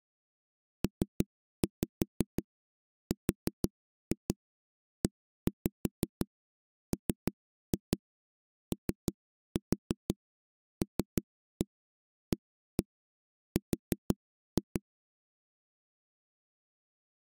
Tap code, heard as knocks on a wall, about 5 knocks a second. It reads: PREMOLAR